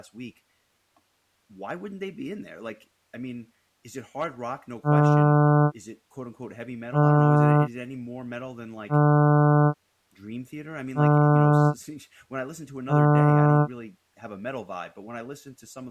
Ship horn signal, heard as a ship's horn, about 150 Hz, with speech in English. 5 short. At sea: I doubt that you are doing enough to avoid a collision.